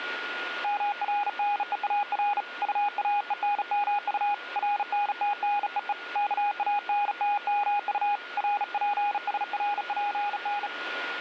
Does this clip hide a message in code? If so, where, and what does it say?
Yes: Morse code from 0.6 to 10.7 s, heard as a keyed tone, hand-sent with a bug key, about 36 wpm, 820 Hz, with radio static and a steady whistle near 1430 Hz. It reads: MRNEAR UAENMU RNTNEE KANTMU RPSRPN